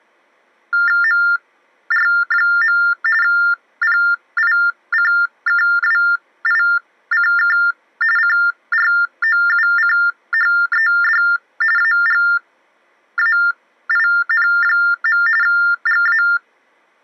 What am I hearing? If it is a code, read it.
TTY/TDD text telephone tones (45.45 baud Baudot), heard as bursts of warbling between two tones, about 400 Hz shift, 1600 Hz centre. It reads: MR. PICKWICK CROUCHED AGAIN. GA